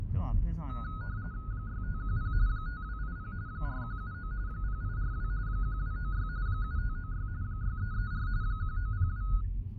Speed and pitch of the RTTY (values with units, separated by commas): 45.45 baud, 170 Hz shift, 1360 Hz centre